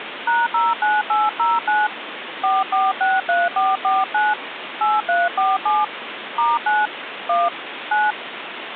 DTMF, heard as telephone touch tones, dialled by hand, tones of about 200 ms, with phone line noise. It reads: #09809 4463449 8347 *9 1 9